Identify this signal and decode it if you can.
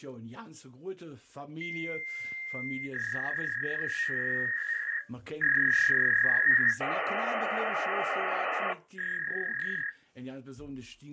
Fax machine handshake, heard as a long tone, a warble and hiss.